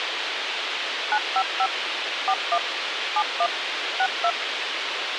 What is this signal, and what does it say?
DTMF, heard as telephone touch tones, dialled by machine, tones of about 60 ms, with radio hiss. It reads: 955 41 71 62